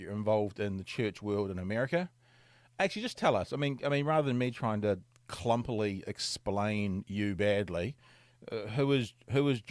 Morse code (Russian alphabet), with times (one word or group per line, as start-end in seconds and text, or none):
none